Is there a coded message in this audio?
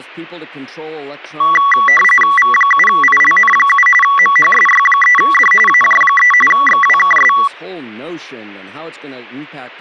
Yes: RTTY (45.45 baud, 850 Hz shift) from 1.4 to 7.5 s, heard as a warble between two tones, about 1550 Hz centre, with static crashes and speech in English. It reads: V7ILN7 MHSY3D AJ3 XWKS